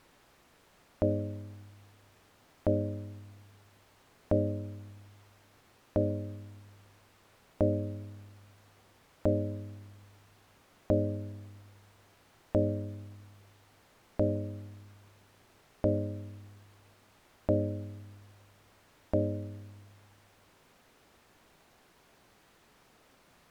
Clock strike, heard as a bell. 12. Twelve o'clock.